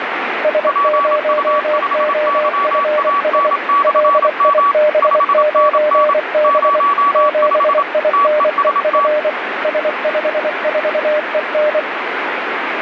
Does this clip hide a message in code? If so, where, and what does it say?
Yes: Morse code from 0.4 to 11.9 s, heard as two keyed tones, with radio static. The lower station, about 24 wpm, 600 Hz: S0OFS LIB9B 7INEF S54EN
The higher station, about 27 wpm, 1140 Hz: PU5YAN/M 5NN 05 TEST